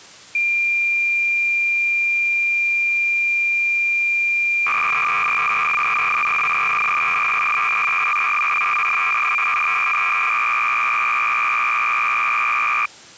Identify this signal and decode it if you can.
Cassette data (Kansas City type), 300 baud, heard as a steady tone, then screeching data.